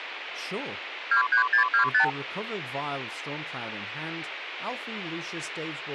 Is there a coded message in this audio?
Yes: multi-frequency trunk signalling (R2, with the far end's replies) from 1.1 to 2.1 s, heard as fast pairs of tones, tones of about 100 ms, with phone line noise and speech in English. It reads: 23625